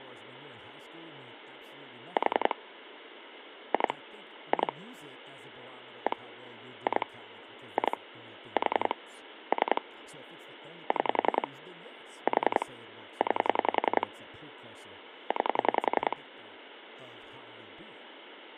Pulse dialling, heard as clicks on a phone line, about 10 pulses a second, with phone line noise and speech in English. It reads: 4 2 2 1 2 2 4 3 6 4 9 9